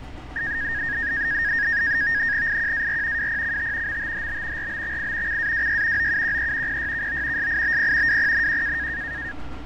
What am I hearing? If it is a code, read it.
NAVTEX (SITOR-B), 100 baud, 170 Hz shift, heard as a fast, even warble, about 1750 Hz centre, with fading and street noise. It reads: IQAR WPCT MTHB RBXI CAWY OUQE PYKO SIBP WPNQ